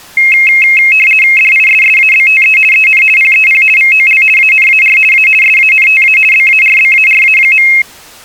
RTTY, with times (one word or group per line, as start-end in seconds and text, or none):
1.4-2.6 DISSABTE
2.7-3.0 EN
3.2-3.6 PEP
3.8-4.2 VOL
4.4-5.0 ANAR
5.1-5.3 A
5.4-6.2 SANTA
6.3-7.7 BARBARA.